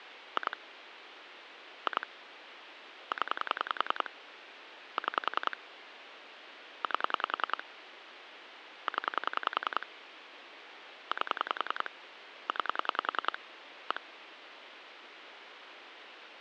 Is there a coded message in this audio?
Yes: pulse dialling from 0.4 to 14.0 s, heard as clicks on a phone line, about 10 pulses a second, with phone line noise. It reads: 2 2 0 6 8 0 8 9 1